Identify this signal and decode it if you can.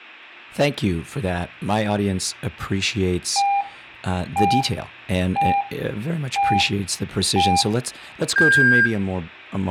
Radio time signal (five pips and a higher one, as on Chinese radio), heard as pips, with speech in English.